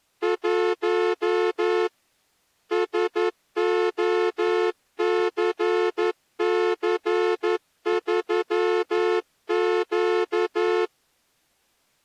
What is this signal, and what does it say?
Morse code, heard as a horn, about 11 wpm. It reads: 1 SOCC3Q